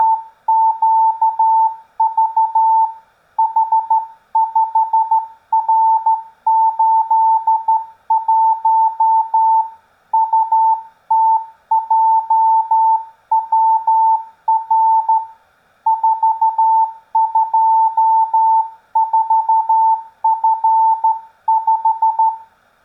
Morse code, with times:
0.0-2.8 …
3.4-9.6 H5R81
10.1-15.2 UTJWR
15.9-22.3 424F5

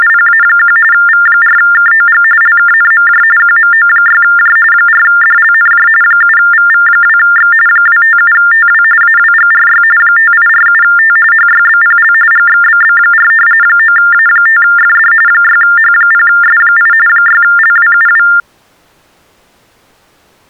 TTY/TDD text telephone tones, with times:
0.0-0.8 …
0.9-2.2 V4KOG
2.4-3.2 LKNMJ
3.4-4.6 QMO6J
4.7-5.9 4DLNJ
6.0-7.5 7VV2X
7.7-8.8 257TW
9.0-9.8 AWGRY
10.0-11.2 5847T
11.3-12.1 HYBPL
12.3-13.3 GXBB4
13.6-15.1 9A5FD
15.3-16.9 6H0S8
17.1-18.3 6LWUW

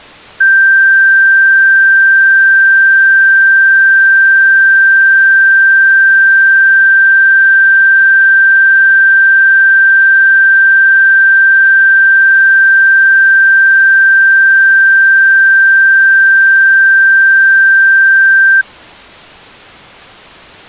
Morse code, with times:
none

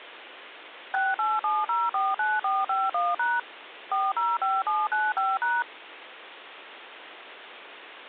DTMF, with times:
0.9-3.4 687049451#
3.9-5.6 405795#

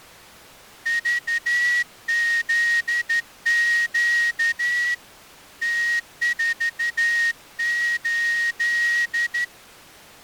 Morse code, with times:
0.9-4.9 VZQ
5.6-9.4 T48

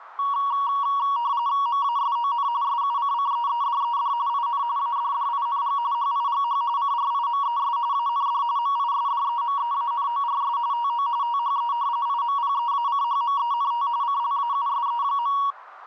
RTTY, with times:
1.7-2.5 MASON
2.6-4.1 SUCCEEDED
4.3-4.6 IN
4.8-5.8 ADDING
5.9-6.6 HIGH
6.8-7.8 CRIMES
7.9-8.4 AND
8.6-10.6 MISDEMEANORS
10.7-11.1 TO
11.2-11.7 THE
12.1-13.9 IMPEACHMENT
14.0-15.4 CLAUSE.

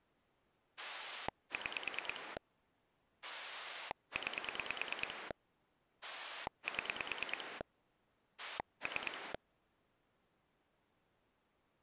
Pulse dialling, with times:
0.8-2.4 6
3.2-5.3 9
6.0-7.6 7
8.4-9.3 3

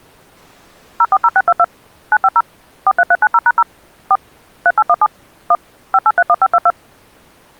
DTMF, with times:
1.0-1.6 040622
2.1-2.4 950
2.9-3.6 43390#0
4.1-4.2 4
4.7-5.1 3817
5.5-5.6 1
5.9-6.7 5831522

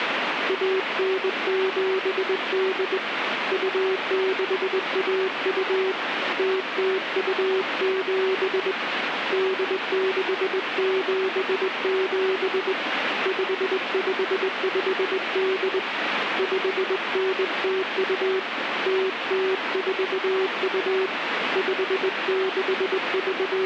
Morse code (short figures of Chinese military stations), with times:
0.5-3.0 1978
3.5-5.9 2612
6.4-8.7 0027
9.3-12.7 8677
13.3-15.8 5558
16.4-18.4 5902
18.9-21.1 0042
21.6-23.7 …

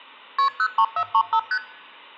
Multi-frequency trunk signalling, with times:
0.4-0.5 KP
0.6-1.4 03435
1.5-1.6 ST

